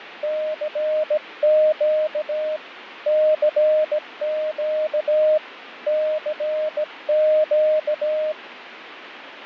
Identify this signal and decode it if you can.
Morse code, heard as a keyed tone, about 17 wpm, 620 Hz, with radio static and fading. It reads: CQ CQ CQ